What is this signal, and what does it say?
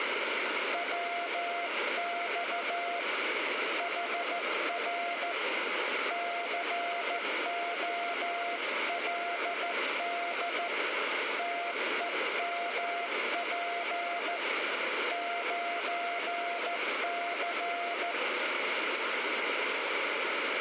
Morse code, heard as a keyed tone, hand-sent with a straight key, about 14 wpm, 690 Hz, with radio static and room echo. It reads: WX HR COLD TEMP 9C